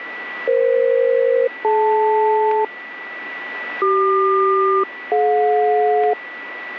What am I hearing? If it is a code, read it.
Aircraft SELCAL, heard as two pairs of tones, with radio static and a steady whistle near 1960 Hz. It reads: EF-DL CQ-DJ